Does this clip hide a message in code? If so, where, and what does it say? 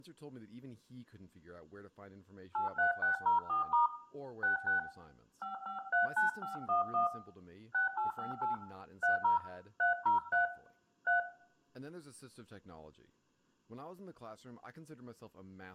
Yes: DTMF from 2.5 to 11.2 s, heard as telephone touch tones, dialled by hand, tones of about 130 ms, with room echo and speech in English. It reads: 83604* 66 5539511 6858 30 303 3